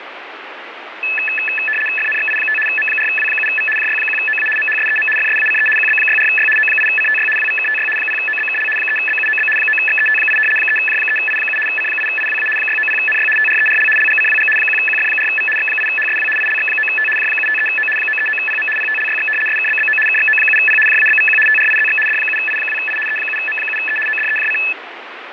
RTTY (75 baud, 850 Hz shift), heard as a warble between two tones, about 2150 Hz centre, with radio static. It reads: FNXI5 M4W7V JY1OA MHSEM FSACE QB64Y O8CTY WVKTY 0OBKL 3BUOB 9XET8 3J3I7 C8IWA 690NY TRERL LGCWG 1QF4V X8HSW ILX9T J753O 939PM PTLYX SKBBO KXO7P JABVQ TRIZX D7I2I E7M7E ODEJC